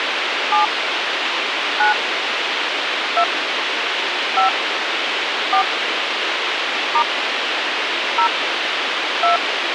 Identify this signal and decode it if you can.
DTMF, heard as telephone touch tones, dialled by hand, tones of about 100 ms, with radio hiss. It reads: 7 9 2 5 4 * 0 2